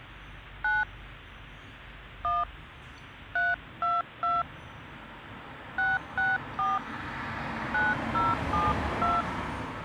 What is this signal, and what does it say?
DTMF, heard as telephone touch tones, dialled by hand, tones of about 190 ms, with street noise. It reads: 9 1 322 664 9072